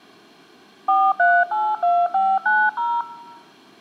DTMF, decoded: 4382590

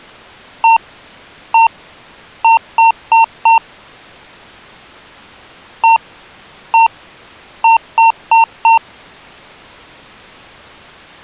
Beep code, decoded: 1-1-4

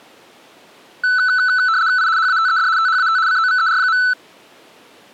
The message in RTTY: I HATED THAT COVER.

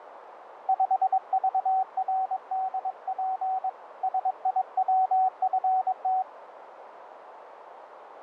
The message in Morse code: 5VRDP SIWFT

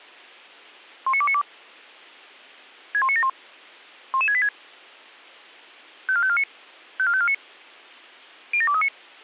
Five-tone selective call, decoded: 19292 61971 11686 54549 54549 07239

